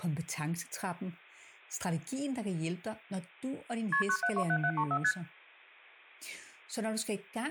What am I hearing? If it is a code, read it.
Multi-frequency trunk signalling (R1, as on North American trunks), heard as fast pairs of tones, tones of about 70 ms, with speech in Danish. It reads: KP 9727734 ST